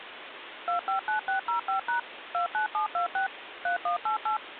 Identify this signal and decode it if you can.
DTMF, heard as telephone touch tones, dialled by machine, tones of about 110 ms, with phone line noise. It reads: 259605# 29726 3188